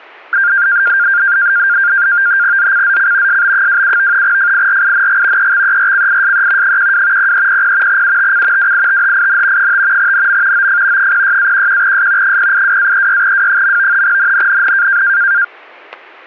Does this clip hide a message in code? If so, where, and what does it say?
Yes: NAVTEX (SITOR-B), 100 baud, 170 Hz shift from 0.3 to 15.4 s, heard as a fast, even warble, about 1500 Hz centre, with static crashes. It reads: ZCZC SB27 FIRING EXERCISE 12 0300 UTC WITHIN 5 NM OF 06-11S 082-36W. NNNN